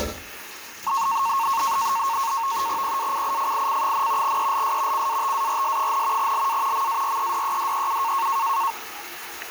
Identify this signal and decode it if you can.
NAVTEX (SITOR-B), 100 baud, 170 Hz shift, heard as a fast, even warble, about 1000 Hz centre, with kitchen noise. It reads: PACIFIC, ELS CATARS, LA MAREDEDEU